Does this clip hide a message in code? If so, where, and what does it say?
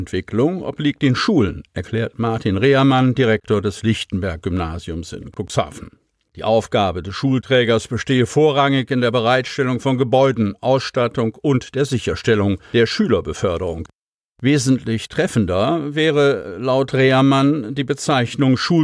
No.